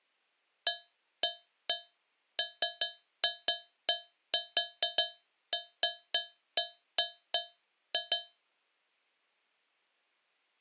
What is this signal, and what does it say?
Irregular taps on a metal pipe. There is no code.